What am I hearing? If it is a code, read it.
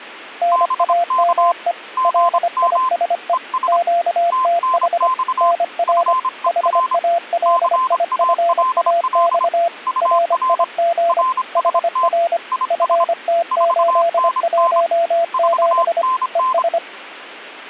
Morse code, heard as two keyed tones. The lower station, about 25 wpm, 680 Hz: NAME LISE QTH NR HALIFAX RIG HR FT817 ES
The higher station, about 26 wpm, 1040 Hz: BK GM ES TNX FER CALL UR RST IS 4NN 4NN